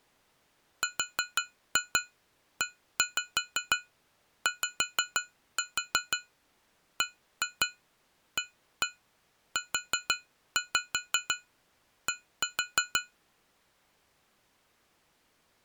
Tap code, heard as taps on glass, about 6 knocks a second. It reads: REYBAUD